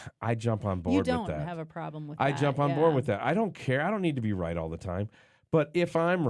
Speech in English. There is no code.